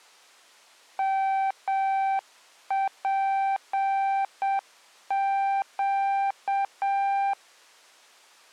Morse code, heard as a keyed tone, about 7 wpm, 780 Hz. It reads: MPQ